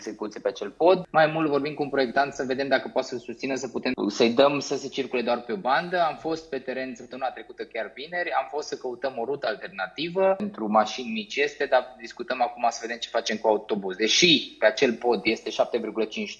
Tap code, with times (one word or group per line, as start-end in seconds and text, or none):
none